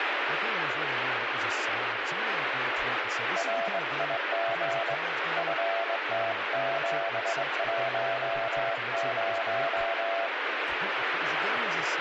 Morse code, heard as a keyed tone, hand-sent with a straight key, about 21 wpm, 680 Hz, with radio static and speech in English. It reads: RIG FT710